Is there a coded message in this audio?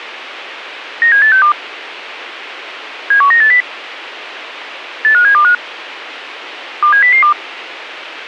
Yes: five-tone selective call (CCIR) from 1.0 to 7.3 s, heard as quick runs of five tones, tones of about 100 ms, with radio hiss. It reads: 97862 71980 85725 27002